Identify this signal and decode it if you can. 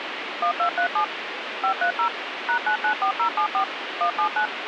DTMF, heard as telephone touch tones, dialled by machine, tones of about 90 ms, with radio hiss. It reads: 1237 530 #994074 179